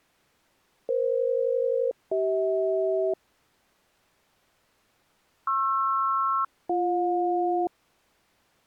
Aircraft SELCAL, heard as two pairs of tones. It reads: EF-CH PR-BJ